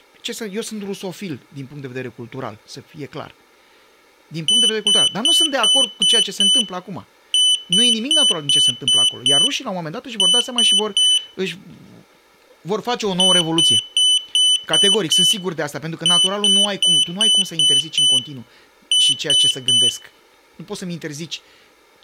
Beep code, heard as a piezo beeper, played twice, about 3000 Hz, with room echo and speech in Romanian. 6-6-3.